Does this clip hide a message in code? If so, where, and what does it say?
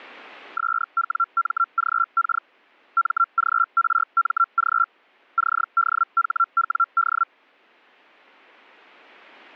Yes: Hellschreiber (Feld-Hell, 122.5 baud) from 0.6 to 7.2 s, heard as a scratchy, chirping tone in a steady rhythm, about 1360 Hz. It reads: SWMGK MGRMG CDHWD